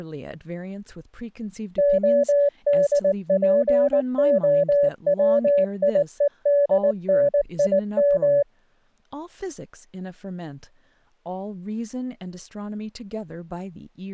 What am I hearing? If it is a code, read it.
Morse code, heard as a keyed tone, machine-sent, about 19 wpm, 570 Hz, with speech in English. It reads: ODPOWIEDNIM